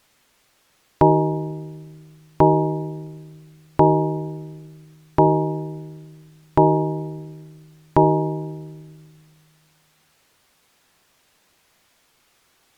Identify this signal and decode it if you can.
Clock strike, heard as a bell. 6. Six o'clock.